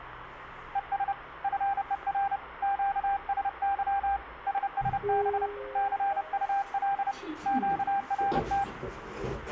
Morse code, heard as a keyed tone, hand-sent with a paddle, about 30 wpm, 790 Hz, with radio static and the noise inside a lift. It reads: ES FER QSY SSB CUL QRT